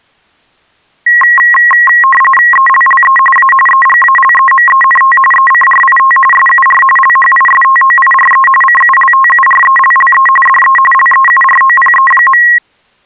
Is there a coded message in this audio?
Yes: RTTY (45.45 baud, 850 Hz shift) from 1.1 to 12.6 s, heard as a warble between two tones, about 1490 Hz centre. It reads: ELLE A EGALEMENT ECRIT SUR LHISTOIRE CULTURELLE DE LEUROPE.